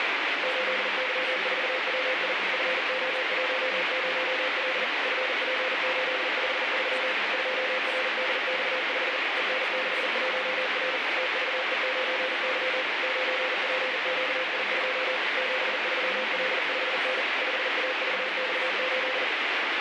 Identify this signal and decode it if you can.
Morse code, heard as a keyed tone, machine-sent, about 40 wpm, 520 Hz, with heavy radio static and speech in Danish. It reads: 8Y4WI FO10L FP853 2RDX5 EN61R TVE9Y 9PQI2 73L5N 5AVX8